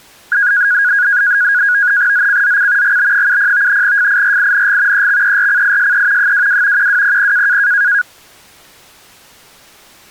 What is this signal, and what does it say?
NAVTEX (SITOR-B), 100 baud, 170 Hz shift, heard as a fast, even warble, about 1550 Hz centre. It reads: ZCZC GB70 FIRING EXERCISE 22 1200